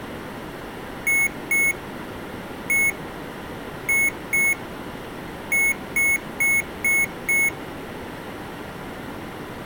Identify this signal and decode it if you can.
Beep code, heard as beeps from a small speaker, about 2200 Hz. 2-1-2-5.